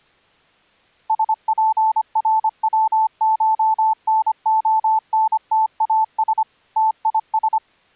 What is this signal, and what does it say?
Morse code (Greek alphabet), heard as a keyed tone, machine-sent, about 25 wpm, 880 Hz. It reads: ΣΠΡΩΧΝΟΝΤΑΣ ΤΙΣ